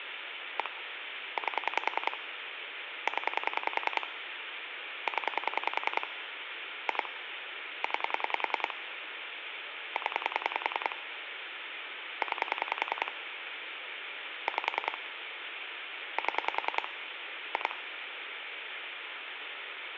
Pulse dialling, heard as clicks on a phone line, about 10 pulses a second, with phone line noise. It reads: 1 8 0 0 2 9 0 9 5 7 2